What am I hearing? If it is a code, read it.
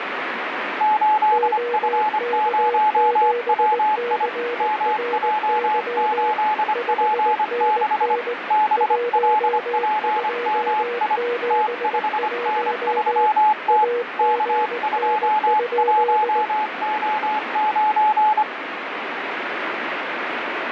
Morse code, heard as two keyed tones, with radio static. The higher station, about 25 wpm, 860 Hz: 8F0WI MJ8P6 BLPMI T5N3T K21O9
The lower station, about 19 wpm, 480 Hz: OK7CRY 5NN 1271 AGN?